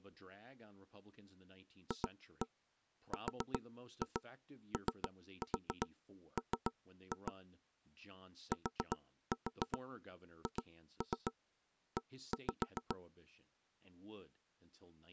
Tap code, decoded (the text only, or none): FROM THE